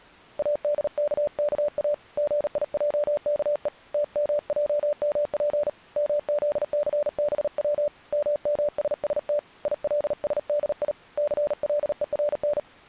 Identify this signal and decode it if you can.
Morse code (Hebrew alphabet), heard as a keyed tone, hand-sent with a paddle, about 38 wpm, 590 Hz. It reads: אדככא גיעכו תמעמף מזסבץ ממששת ילשדי סלורן